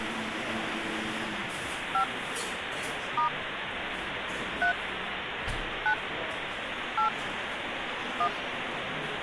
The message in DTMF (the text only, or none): 5 * 3 9 8 1